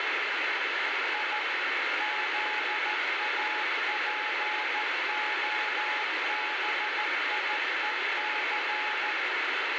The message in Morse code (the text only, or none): I ZAPOBIEC